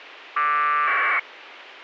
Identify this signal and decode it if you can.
Packet radio (AX.25, as in APRS), 1200 baud, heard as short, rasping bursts, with radio hiss.